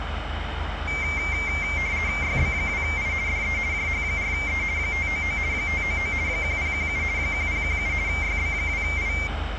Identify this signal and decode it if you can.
RTTY (50 baud, 170 Hz shift), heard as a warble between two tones, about 2200 Hz centre, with radio static, room echo and the noise of a residential street. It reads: YB2I DE JH4E 599 599 1017 1017 YB2I